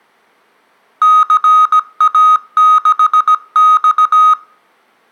Morse code, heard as electronic beeps, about 17 wpm, 1250 Hz, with room echo. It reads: CA6X